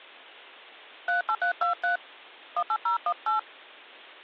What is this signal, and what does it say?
DTMF, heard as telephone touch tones, dialled by hand, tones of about 100 ms. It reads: 38323 18018